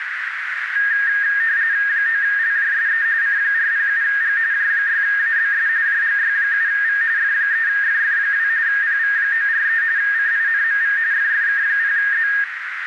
RTTY (45.45 baud, 170 Hz shift), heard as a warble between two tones, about 1750 Hz centre, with radio static and a narrow filter. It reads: 9LJSE C407G J6ABS JGY7V F3FF2 PV943 CINMV FFK0Z